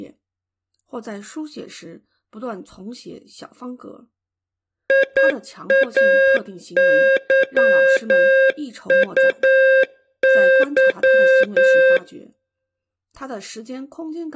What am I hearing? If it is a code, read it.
Morse code, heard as a keyed tone, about 9 wpm, 530 Hz. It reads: IAYUY